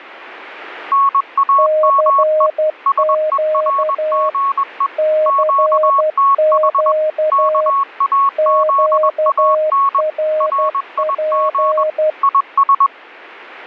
Morse code, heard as two keyed tones. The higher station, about 21 wpm, 1100 Hz: NAME SERGE QTH KAZAN RIG IS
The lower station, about 12 wpm, 620 Hz: CQ CQ QRP